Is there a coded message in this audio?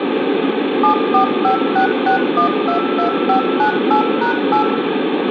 Yes: DTMF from 0.8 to 4.6 s, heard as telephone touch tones, dialled by machine, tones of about 110 ms, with phone line noise and room echo. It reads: 74566122598#8